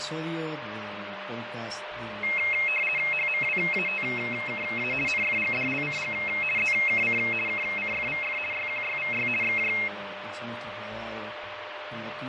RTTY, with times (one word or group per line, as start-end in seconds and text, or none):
3.1-4.9 HMWATKA
5.1-6.1 NFGDLCG
6.6-7.2 ZKC
7.5-8.4 KCFVF
8.5-9.3 YQYVY
9.4-9.7 XJ